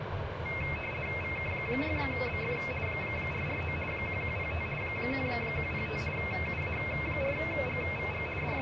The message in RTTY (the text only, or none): VK6BF 449 1105 1105 UA4GVG …